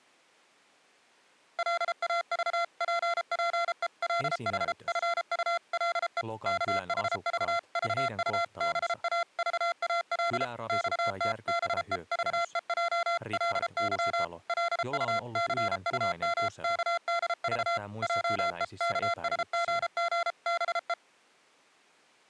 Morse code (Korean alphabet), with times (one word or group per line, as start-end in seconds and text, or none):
1.6-6.2 골짜구니가
6.5-10.4 울리도록
10.7-14.2 커다랗게
14.5-17.8 기침을
18.0-20.9 하였다